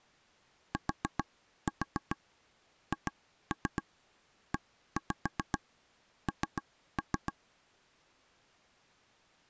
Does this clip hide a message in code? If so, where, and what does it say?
Yes: tap code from 0.7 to 7.3 s, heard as taps on a table, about 7 knocks a second. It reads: THEN